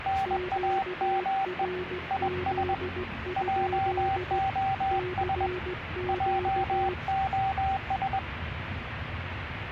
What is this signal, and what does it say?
Morse code, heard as two keyed tones, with radio static and the noise inside a car. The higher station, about 21 wpm, 780 Hz: NAME IS JOS JOS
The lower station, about 16 wpm, 360 Hz: QRZ? CQ